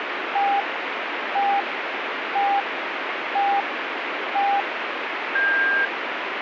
Radio time signal (five pips and a higher one, as on Chinese radio), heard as pips, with radio static.